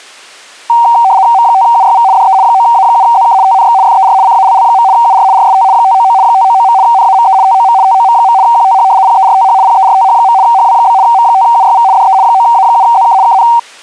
RTTY (75 baud, 170 Hz shift), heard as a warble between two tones, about 850 Hz centre. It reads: M5UYV DE 9A7ZK TNX FER CALL. UR RST 599 599. NAME TOM TOM. QTH PERTH PERTH. HW? M5UYV DE 9A7ZK KN